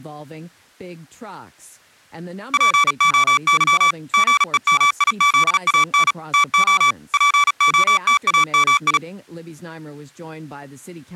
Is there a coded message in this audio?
Yes: Morse code (Greek alphabet) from 2.5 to 9.0 s, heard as electronic beeps, machine-sent, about 36 wpm, 1150 Hz, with speech in English. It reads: ΠΟΥ ΓΕΜΙΖΑΝ ΤΟ ΠΟΤΑΜΙ